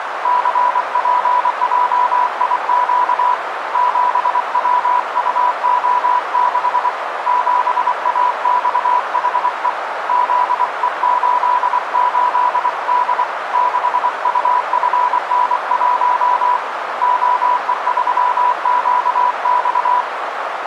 Morse code, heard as a keyed tone, hand-sent with a paddle, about 24 wpm, 990 Hz, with radio static and a narrow filter. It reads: CPJIQ 7WUO6 7AXHE ZE88D 6UFN1 OE3QX